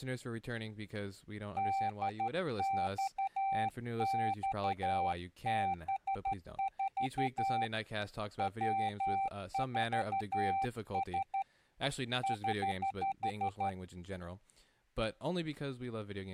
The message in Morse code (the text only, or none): DXXB4 W4S <HH>